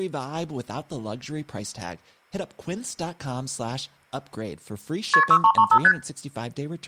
Multi-frequency trunk signalling (R1, as on North American trunks), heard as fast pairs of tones, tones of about 70 ms, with speech in English. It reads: KP 6335 ST